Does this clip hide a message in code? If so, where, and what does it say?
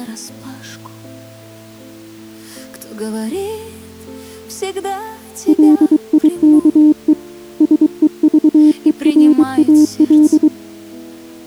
Yes: Morse code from 5.4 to 10.5 s, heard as a keyed tone, hand-sent with a paddle, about 23 wpm, 300 Hz. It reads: LIKE SEVERAL